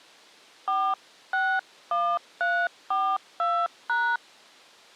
DTMF, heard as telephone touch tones, dialled by hand, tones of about 260 ms. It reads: 461342#